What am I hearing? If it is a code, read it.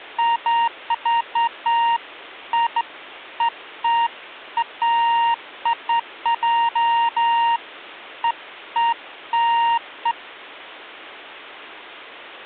Beeps of irregular length. There is no code.